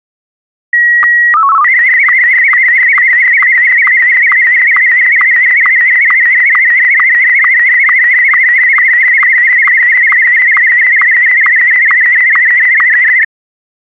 SSTV (slow-scan television), Martin M1, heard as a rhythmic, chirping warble.